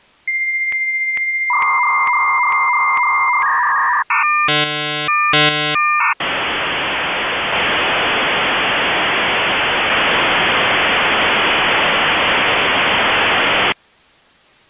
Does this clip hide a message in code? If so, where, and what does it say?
Yes: dial-up modem handshake (V.34 or later) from 0.3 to 13.7 s, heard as a whistle, warbles, then hiss.